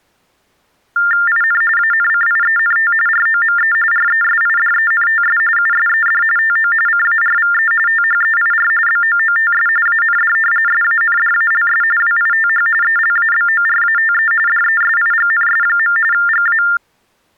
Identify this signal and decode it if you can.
TTY/TDD text telephone tones (45.45 baud Baudot), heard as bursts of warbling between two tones, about 400 Hz shift, 1600 Hz centre. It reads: IN ANCIENT ROME RESIDENTS USED TO CARVE THEIR BOOTS AND SANDALS WITH ELABORATE DESIGNS. GA